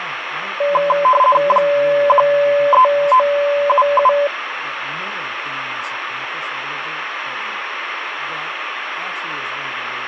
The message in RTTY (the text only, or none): 13977